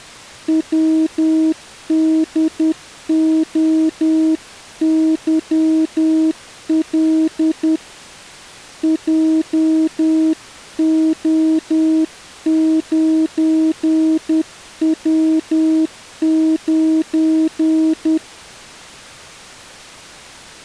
Morse code, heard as a keyed tone, hand-sent with a paddle, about 10 wpm, 320 Hz. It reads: WDOYL JO9W9